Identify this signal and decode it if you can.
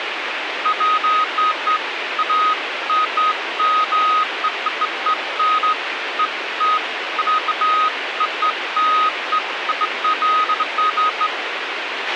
Beeps of irregular length, with radio hiss and a squelch burst at the end. There is no code.